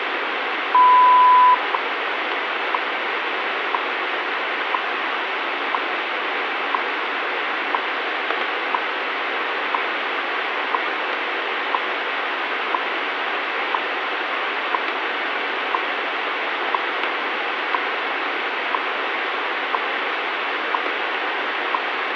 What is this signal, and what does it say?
Radio time signal (WWV, Colorado), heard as ticks, one a second, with radio static.